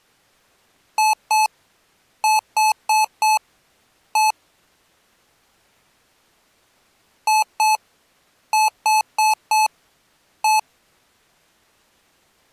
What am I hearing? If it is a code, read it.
Beep code, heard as beeps from a small speaker, played twice, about 860 Hz. 2-4-1.